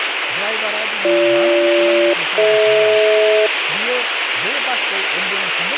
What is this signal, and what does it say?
Aircraft SELCAL, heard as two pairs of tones, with radio hiss and speech in Bodo. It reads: BG-DH